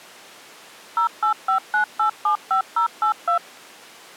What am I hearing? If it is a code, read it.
DTMF, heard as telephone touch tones, dialled by machine, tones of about 100 ms. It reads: 0859875082